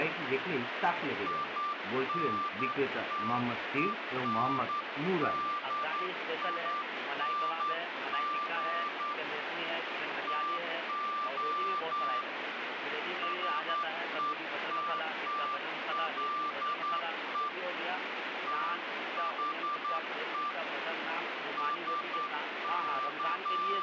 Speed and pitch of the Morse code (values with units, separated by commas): 10 wpm, 1180 Hz